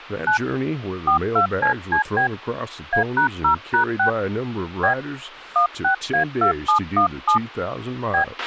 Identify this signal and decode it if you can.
DTMF, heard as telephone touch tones, dialled by hand, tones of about 100 ms, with a squelch burst at the end and speech in English. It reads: 9 42CCB A#0#6 B 16A2717 B